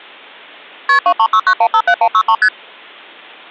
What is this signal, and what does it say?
Multi-frequency trunk signalling (R1, as on North American trunks), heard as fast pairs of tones, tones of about 70 ms. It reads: KP 2369157163 ST